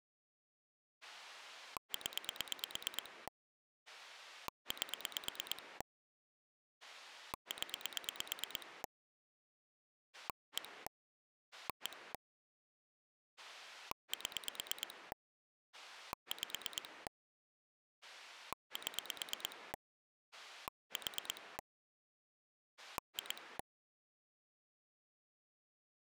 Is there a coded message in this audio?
Yes: pulse dialling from 1.0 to 23.6 s, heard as a rotary dial, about 9 pulses a second. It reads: 0 8 0 1 1 7 5 7 4 2